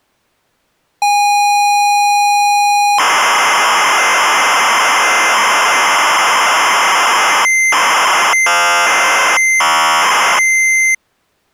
ZX Spectrum tape loading, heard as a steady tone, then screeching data.